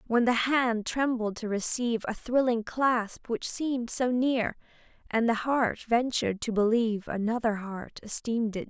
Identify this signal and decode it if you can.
Speech in English. There is no code.